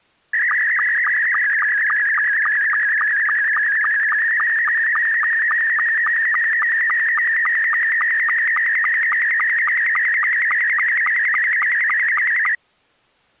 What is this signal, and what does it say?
SSTV (slow-scan television), Scottie S2, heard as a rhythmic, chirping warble.